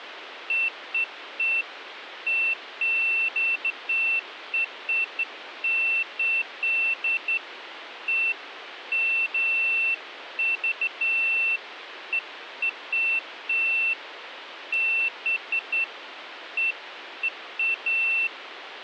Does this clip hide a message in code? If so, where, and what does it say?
No, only beeps of irregular length, with phone line noise.